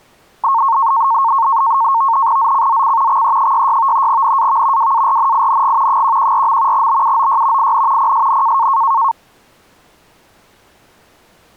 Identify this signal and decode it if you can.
NAVTEX (SITOR-B), 100 baud, 170 Hz shift, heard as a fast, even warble, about 1000 Hz centre. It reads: ZCZC XE66 NAV WARNING 114. BUOY IN PSN